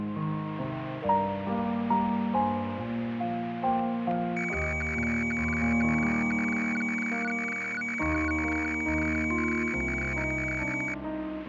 Weather fax (radiofax), 120 lines a minute, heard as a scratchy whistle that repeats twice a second.